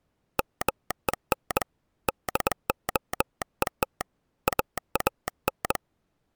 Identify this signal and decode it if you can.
Morse code, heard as a telegraph sounder, hand-sent with a bug key, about 21 wpm. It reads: MEN DOET AAN